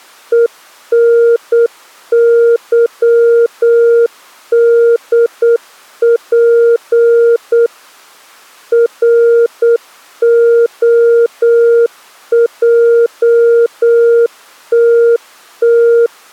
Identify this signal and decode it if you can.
Morse code, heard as a keyed tone, machine-sent, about 8 wpm, 470 Hz. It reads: ENYDP ROJTT